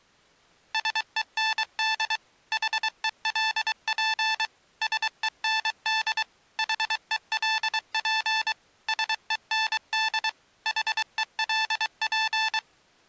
Morse code, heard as electronic beeps, machine-sent, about 23 wpm, 880 Hz. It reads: SEND HELP SEND HELP SEND HELP